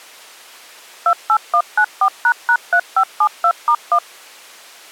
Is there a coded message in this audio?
Yes: DTMF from 1.1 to 4.0 s, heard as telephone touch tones, dialled by machine, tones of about 70 ms. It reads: 28194##3572*1